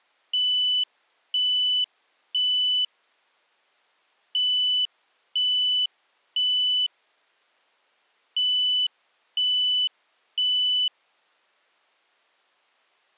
Alarm pattern, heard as an alarm's beeps, played three times, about 3000 Hz. Temporal three. Smoke or fire, evacuate.